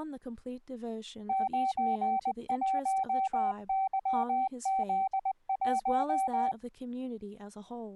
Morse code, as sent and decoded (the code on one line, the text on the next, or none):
----. .---- -.-- --.. .----
91YZ1